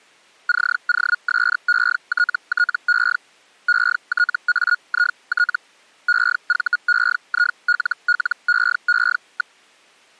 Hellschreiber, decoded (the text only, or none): COSETTE ETAIT EVEILLEE.